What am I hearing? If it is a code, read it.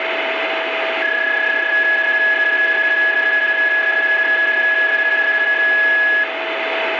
PSK31 (31.25 baud), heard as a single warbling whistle, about 1700 Hz, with radio static and a steady whistle near 650 Hz.